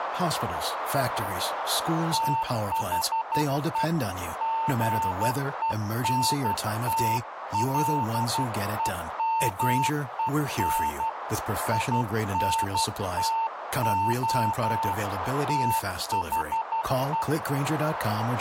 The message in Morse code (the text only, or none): THE GENTLEMEN INTO THE